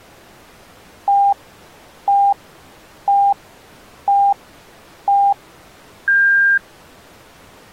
Radio time signal (five pips and a higher one, as on Chinese radio), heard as pips.